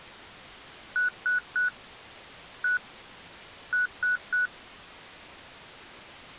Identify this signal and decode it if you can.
Beep code, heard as beeps from a small speaker, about 1480 Hz. 3-1-3. In Phoenix BIOS tables: interrupt mask register failure.